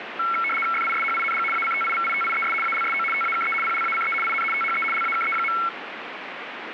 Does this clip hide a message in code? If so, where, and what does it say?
Yes: RTTY (75 baud, 850 Hz shift) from 0.2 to 5.7 s, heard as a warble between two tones, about 1800 Hz centre, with radio static. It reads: FISHING ACTIVITIES ALSO TAKE PLACE IN THE LAKE.